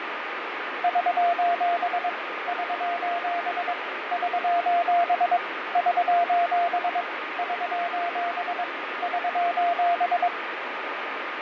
Morse code, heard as a keyed tone, machine-sent, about 22 wpm, 690 Hz, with radio static and fading. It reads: <SOS> <SOS> <SOS> <SOS> <SOS> <SOS>